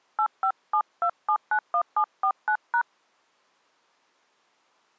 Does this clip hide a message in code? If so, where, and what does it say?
Yes: DTMF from 0.2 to 2.8 s, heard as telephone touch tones, dialled by hand, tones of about 80 ms. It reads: 8572791749#